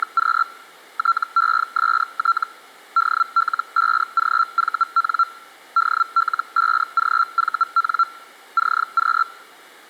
Hellschreiber (Feld-Hell, 122.5 baud), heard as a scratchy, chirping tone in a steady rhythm, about 1360 Hz. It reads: … TEST DL5GVN DL5GVN CQ